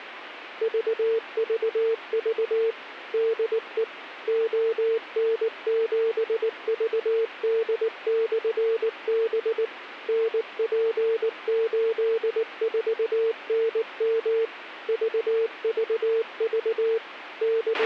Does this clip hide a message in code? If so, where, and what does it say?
Yes: Morse code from 0.6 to 17.9 s, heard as a keyed tone, machine-sent, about 19 wpm, 450 Hz, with radio hiss and a squelch burst at the end. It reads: VVV DE ON7VD/B NP84NM VVV …